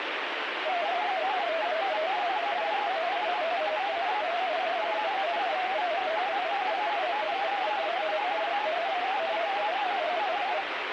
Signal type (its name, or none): multi-tone FSK (Olivia or MFSK type)